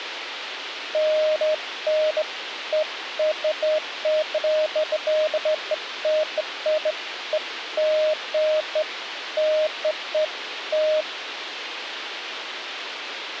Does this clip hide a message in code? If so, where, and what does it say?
No, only beeps of irregular length, with radio hiss and a squelch burst at the end.